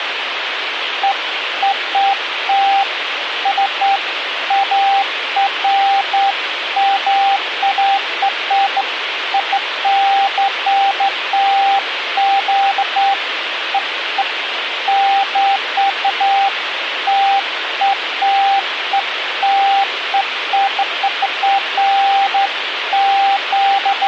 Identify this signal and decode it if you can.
Beeps of irregular length, with radio hiss. There is no code.